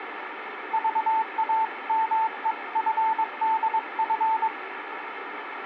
Morse code (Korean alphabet), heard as a keyed tone, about 22 wpm, 890 Hz, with radio static. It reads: 로마는